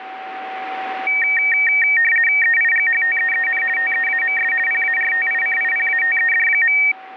RTTY (50 baud, 450 Hz shift), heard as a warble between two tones, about 2050 Hz centre, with radio static and a steady whistle near 760 Hz. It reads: EIGHTEEN TEAMS PARTICIPATED.